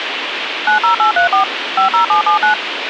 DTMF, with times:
0.7-1.4 90834
1.8-2.5 50779

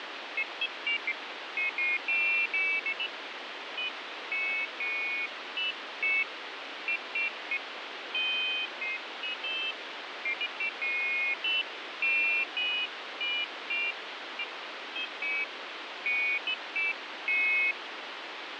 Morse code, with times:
none

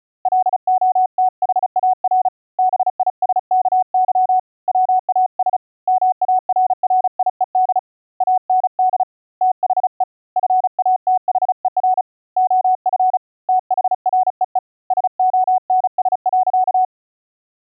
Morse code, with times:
0.3-2.3 LOTHAR
2.6-4.4 BISKY
4.7-5.6 WAS
5.9-7.8 MARRIED
8.2-9.0 AND
9.4-10.0 THE
10.4-12.0 FATHER
12.4-13.2 OF
13.5-14.6 THREE
14.9-16.8 SONS.

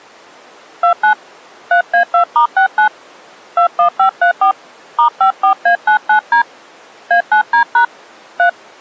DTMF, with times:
0.8-1.1 29
1.7-2.9 3A2*69
3.6-4.5 21534
5.0-6.4 *54A99D
7.1-7.8 A9D#
8.4-8.5 3

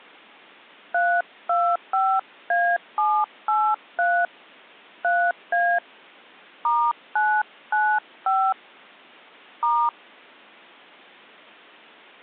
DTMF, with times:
0.9-4.3 325A783
5.0-5.8 3A
6.6-8.5 *995
9.6-9.9 *

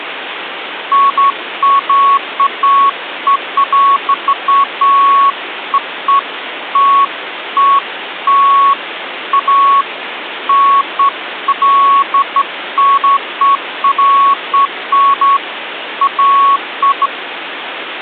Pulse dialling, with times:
none

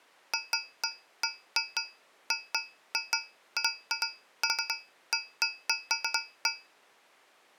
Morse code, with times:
none

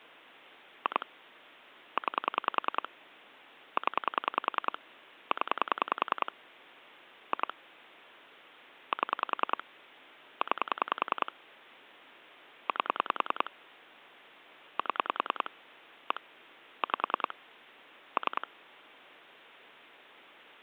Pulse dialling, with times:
0.9-1.1 2
2.0-2.9 9
3.8-4.8 0
5.3-6.3 0
7.3-7.5 2
8.9-9.6 7
10.4-11.3 9
12.7-13.5 8
14.8-15.5 7
16.1-16.2 1
16.8-17.3 5
18.2-18.5 3

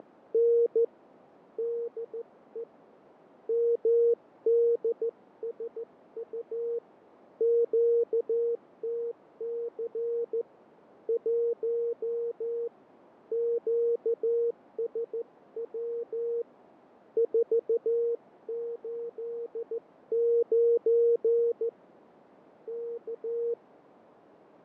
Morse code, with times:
0.0-0.8 …
1.6-2.6 DE
3.5-6.8 MDSU
7.4-10.4 QTC
11.1-12.7 1
13.3-16.4 QSW
17.2-21.7 489
22.7-23.5 K

